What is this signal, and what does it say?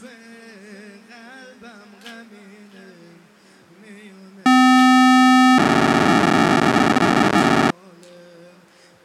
POCSAG pager data (512 baud), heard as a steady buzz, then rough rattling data.